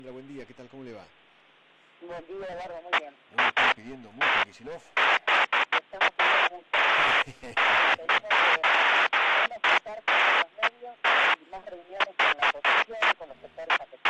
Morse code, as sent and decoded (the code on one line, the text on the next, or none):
none